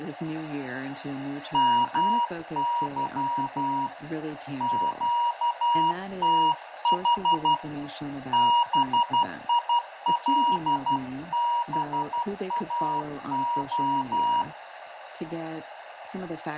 Morse code, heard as a keyed tone, hand-sent with a paddle, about 12 wpm, 950 Hz, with radio static, fading, a narrow filter, room echo and speech in English. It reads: MY QTH BILBAO